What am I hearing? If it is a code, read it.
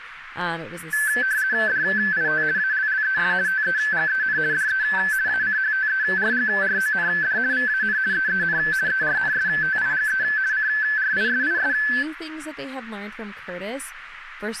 RTTY (50 baud, 170 Hz shift), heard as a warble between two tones, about 1650 Hz centre, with radio static and speech in English. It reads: DIT ALLES TEGEN DE ACHTERGROND VAN EEN ERNSTIGE CRISIS